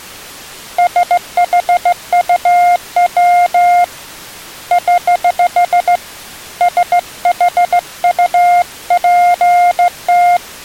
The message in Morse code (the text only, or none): SHUW <HH> SHUPT